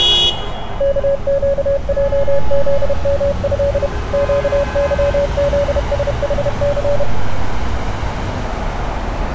Morse code (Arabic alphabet), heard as a keyed tone, machine-sent, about 31 wpm, 560 Hz, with radio static and street noise. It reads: كقجذمه قظذسحث